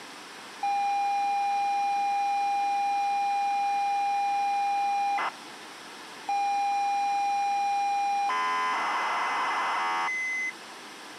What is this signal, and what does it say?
ZX Spectrum tape loading, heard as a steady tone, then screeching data, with tape hiss.